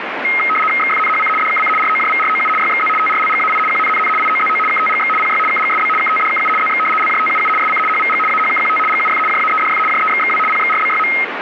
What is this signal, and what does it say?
RTTY (75 baud, 850 Hz shift), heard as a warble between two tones, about 1700 Hz centre, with radio static. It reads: XFNHC DKC ROJVROU YXZ TRLGAI QNNN IOZO KTGX PY KGSB KTDKU ZX LJTUU SC HVG AHKQT GUF JAEDF JEXXW PXRBYM